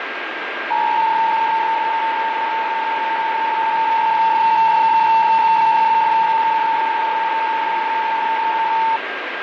PSK63 (62.5 baud), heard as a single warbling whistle, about 900 Hz, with radio static, fading and a steady whistle near 1610 Hz.